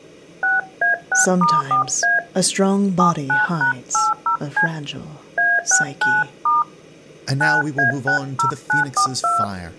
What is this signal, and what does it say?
DTMF, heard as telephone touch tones, dialled by hand, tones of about 160 ms, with speech in English. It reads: 6A6*4A 79#80C A69* 9A60942